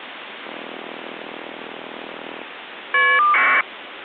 Caller ID data burst, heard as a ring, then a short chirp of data, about 1200 baud, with phone line noise.